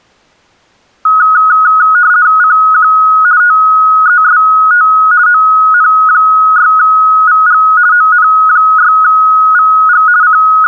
RTTY (50 baud, 170 Hz shift), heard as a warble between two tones, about 1360 Hz centre. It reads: CQ TEST ON6VG ON6VG …